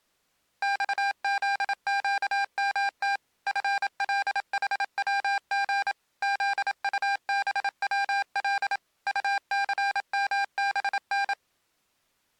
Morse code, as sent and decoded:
-..- --.. --.- -- - / ..-. .-.. .... .-- --. / --.. ..- -... .-- .-.. / ..- -.-. -- -... -.
XZQMT FLHWG ZUBWL UCMBN

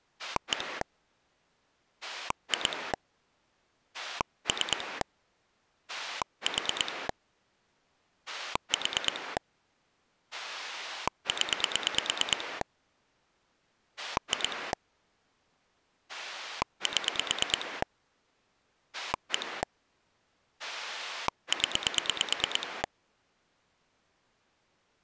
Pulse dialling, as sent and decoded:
1 / 2 / 3 / 4 / 4 / 10 / 2 / 7 / 1 / 10
1 2 3 4 4 0 2 7 1 0

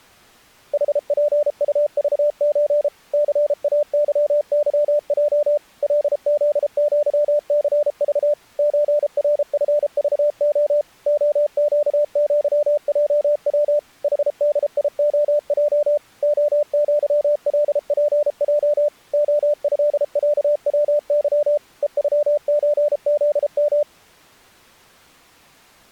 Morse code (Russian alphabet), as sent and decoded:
.... .--. ..- ...- ---. / -.-. .- -.-- -.-- .--- / .-.. --.. --.-- -.-. ...- / ---. .-. ..-. ...- --- / --- --.- --.-- .--- .-- / .... -.. .. --- .--- / --- --.-- .-.. .--. .--- / --- ..-.. .-.- .-- -.-- / . ..-- ---. --.. --
ХПУЖЧ ЦАЫЫЙ ЛЗЪЦЖ ЧРФЖО ОЩЪЙВ ХДИОЙ ОЪЛПЙ ОЭЯВЫ ЕЮЧЗМ

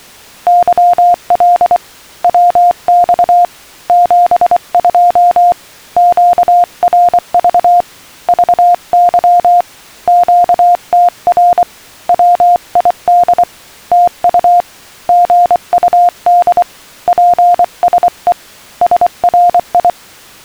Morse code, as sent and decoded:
-.-- .-.. / .-- -..- / --... ..--- / --.- .-. ...- / ...- -.-- / --.- - .-. / .-- .. -.. / - ..- / --. ..- -.. / .--. ... . / ... .-. ..
YL WX 72 QRV VY QTR WID TU GUD PSE SRI

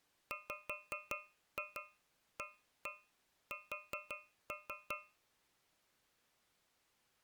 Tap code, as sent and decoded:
5-2 1-1 4-3
WAS

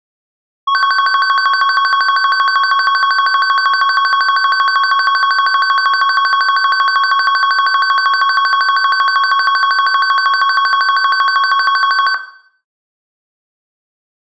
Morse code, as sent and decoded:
none

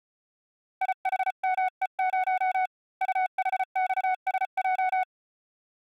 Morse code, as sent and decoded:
.. .... -- . ----- / ..- .... -..- ... .---
IHME0 UHXSJ

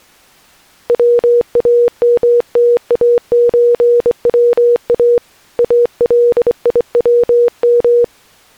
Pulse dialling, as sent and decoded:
none

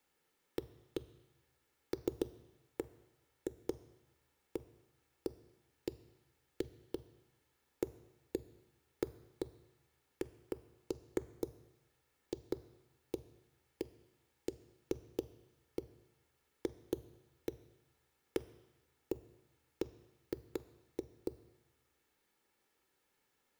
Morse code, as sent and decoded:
none

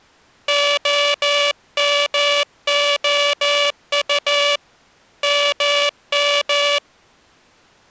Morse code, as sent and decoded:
--- -- --- ..- / -- --
OMOU MM

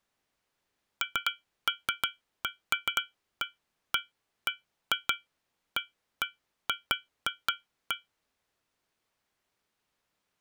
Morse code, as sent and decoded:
none

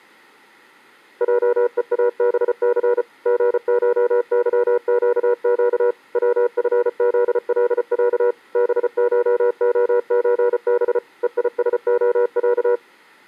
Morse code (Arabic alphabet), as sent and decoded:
.--- . .- -... -.-. / --. ---- -.-- --.- --.- / .-- ..-. --.. .-.. .-.- / -... ---- --- ---. -... / . .. ... --- .-.-
جءابث غشظقق وفذلع بشخزب ءيسخع

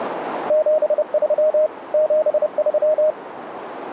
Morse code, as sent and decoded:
--... ...-- / --... ...--
73 73

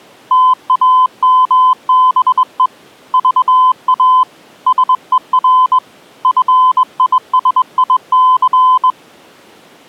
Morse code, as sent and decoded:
- .- -- -... . / ...- .- / ... . .-. / ..-. .. ... .. -.-.
TAMBE VA SER FISIC

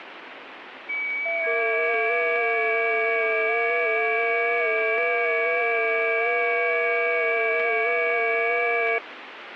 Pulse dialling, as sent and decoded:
none

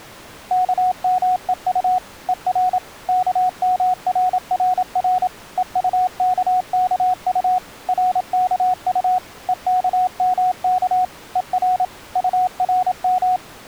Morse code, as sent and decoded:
-.- -- . ..- / . .-. / -.- -- .-. .-. .-. / . ..- -.- -.- ..- / .-. -.- ..- / . -.- -- -.- / . .-. / ..- .-. --
KMEU ER KMRRR EUKKU RKU EKMK ER URM

